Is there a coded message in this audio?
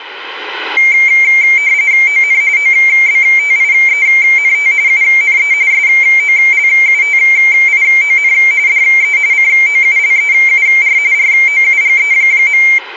Yes: RTTY (45.45 baud, 170 Hz shift) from 0.8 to 12.8 s, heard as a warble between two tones, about 2200 Hz centre. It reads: ON OBTIENT UNE SOLUTION DE COULEUR ROUGE.